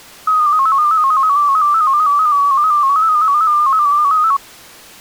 Multi-tone FSK (Olivia or MFSK type), about 250 Hz wide, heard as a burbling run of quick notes, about 15.625 baud.